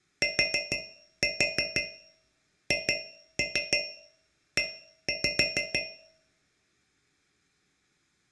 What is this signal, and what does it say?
Tap code, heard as taps on a metal pipe, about 6 knocks a second, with room echo. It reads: THE